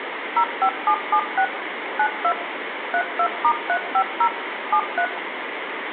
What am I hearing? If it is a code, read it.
DTMF, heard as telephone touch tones, dialled by machine, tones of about 80 ms, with phone line noise and room echo. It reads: 05776 92 32*350 73